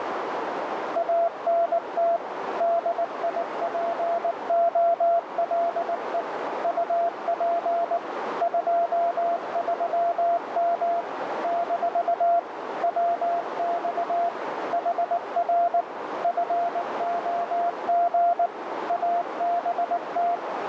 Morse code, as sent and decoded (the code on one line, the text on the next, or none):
.- -. - / -.. .. .--. --- .-.. . / ..- .--. / ..--- ...-- -- / -....- / .-- -..- / .... .-. / ..-. --- --. / .- -... -
ANT DIPOLE UP 23M - WX HR FOG ABT